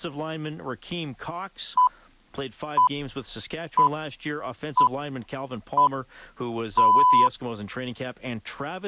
Radio time signal (six pips, as the Greenwich Time Signal), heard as pips, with speech in English.